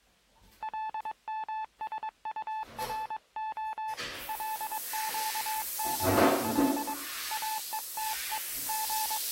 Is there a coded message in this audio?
Yes: Morse code (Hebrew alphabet) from 0.6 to 9.3 s, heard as a keyed tone, hand-sent with a paddle, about 22 wpm, 870 Hz, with the noise of a restroom. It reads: למשטרה לקבל אותו …